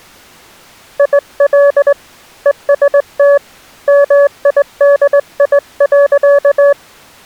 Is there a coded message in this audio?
Yes: Morse code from 0.9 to 6.8 s, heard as a keyed tone, hand-sent with a straight key, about 19 wpm, 570 Hz. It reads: IL EST MIDI.